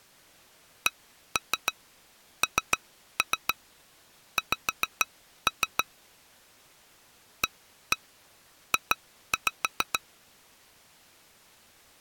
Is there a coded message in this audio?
Yes: tap code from 0.9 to 10.0 s, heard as taps on glass, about 6 knocks a second. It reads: CNX AJ